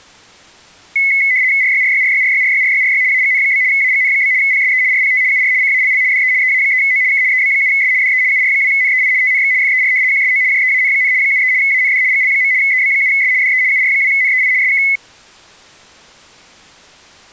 RTTY (75 baud, 170 Hz shift), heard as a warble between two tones, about 2100 Hz centre. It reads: RYRYRYRYRYRYRY AGN? AGN? PSE RPT UR CALL DE EA3O K EB7S DE UR2NEI TNX FER QSO JEAN, 73 AND GL. EB7S DE UR2NEI SK